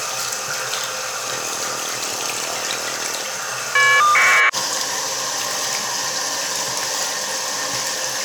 Caller ID data burst, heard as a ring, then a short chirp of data, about 1200 baud, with the noise of a restroom.